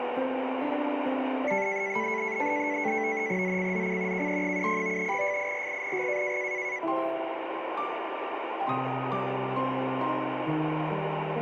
NAVTEX (SITOR-B), 100 baud, 170 Hz shift, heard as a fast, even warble, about 2100 Hz centre, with radio static. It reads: ZCZC KE70 FIRING